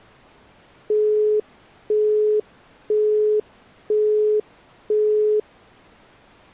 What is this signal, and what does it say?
Telephone call progress tone (single-tone plan, as in Europe, Japan and elsewhere), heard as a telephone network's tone, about 420 Hz, 0.5 s on and 0.5 s off. Busy tone.